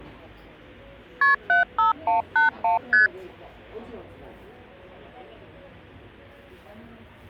Multi-frequency trunk signalling (R1, as on North American trunks), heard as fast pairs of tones, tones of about 140 ms, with the noise of a cafe. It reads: KP 75181 ST